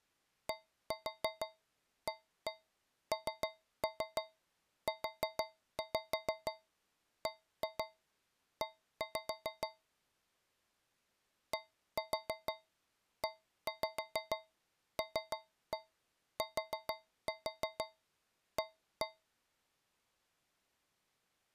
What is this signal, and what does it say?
Tap code, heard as taps on a metal pipe, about 6 knocks a second. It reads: DANUBE DELTA